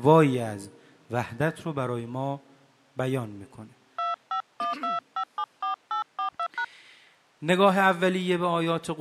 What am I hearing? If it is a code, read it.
DTMF, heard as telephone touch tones, dialled by hand, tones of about 110 ms. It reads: 2512574842#